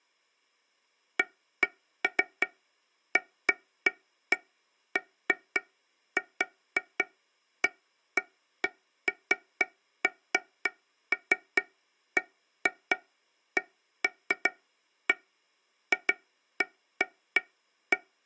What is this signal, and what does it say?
Irregular taps on a table. There is no code.